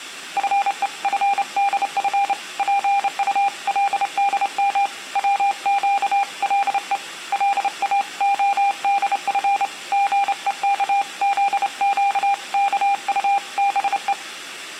Morse code (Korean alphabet), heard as a keyed tone, hand-sent with a straight key, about 28 wpm, 800 Hz, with room echo. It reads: 나는 지금 배가 고픈 상태이다